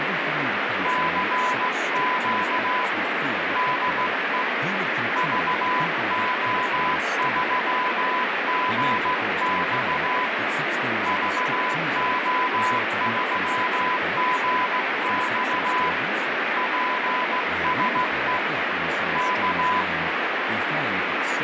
Morse code, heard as a keyed tone, hand-sent with a straight key, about 16 wpm, 1000 Hz, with heavy radio static and speech in English. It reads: CQ DE VO3GX VO3GX PSE K